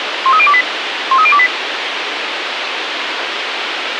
Five-tone selective call (ZVEI), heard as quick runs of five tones, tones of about 70 ms, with radio hiss. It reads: 13028 13028